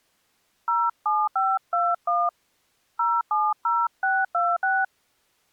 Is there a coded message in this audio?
Yes: DTMF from 0.7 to 4.8 s, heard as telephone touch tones, dialled by hand, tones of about 220 ms. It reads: 07521 070626